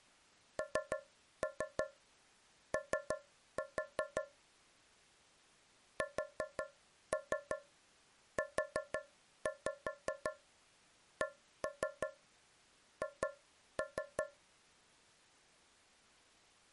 Tap code, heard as taps on a metal pipe, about 5 knocks a second. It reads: NO SUCH